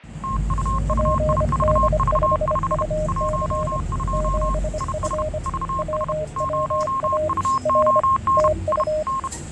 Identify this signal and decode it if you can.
Morse code, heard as two keyed tones, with fading and the noise inside a bus. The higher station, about 31 wpm, 1070 Hz: TUUIVV5 12 IS VS 0UON I N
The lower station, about 25 wpm, 620 Hz: PD5UC 7F WWA R TU